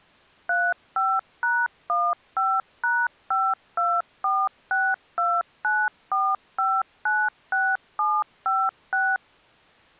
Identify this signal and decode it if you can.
DTMF, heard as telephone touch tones, dialled by machine, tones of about 230 ms. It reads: 35#15#5246294596756